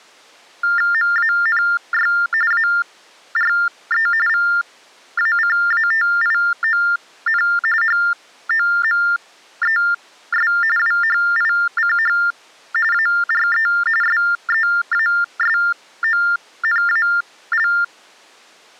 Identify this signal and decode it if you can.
TTY/TDD text telephone tones (45.45 baud Baudot), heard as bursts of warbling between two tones, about 400 Hz shift, 1600 Hz centre. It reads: MANY ARE VACATION HOMES WHICH ARE SEASONAL